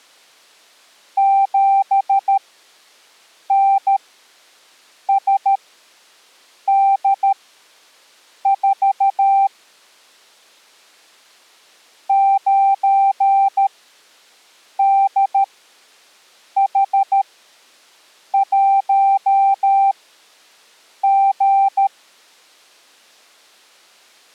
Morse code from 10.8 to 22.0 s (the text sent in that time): 9DH1G